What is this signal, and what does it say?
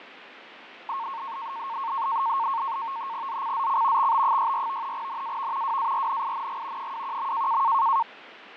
NAVTEX (SITOR-B), 100 baud, 170 Hz shift, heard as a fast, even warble, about 1000 Hz centre, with radio static and fading. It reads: ZCZC XB64 NAV WARNING 21.